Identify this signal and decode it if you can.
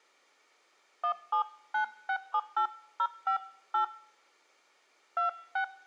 DTMF, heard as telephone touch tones, dialled by hand, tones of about 100 ms. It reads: 179678058 26